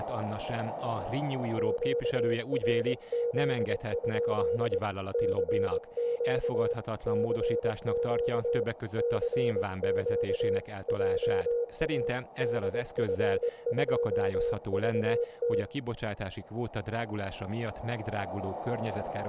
Morse code, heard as a keyed tone, hand-sent with a paddle, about 22 wpm, 480 Hz, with room echo and speech in Hungarian. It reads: QRZ? CQ CQ CQ JA DF2VT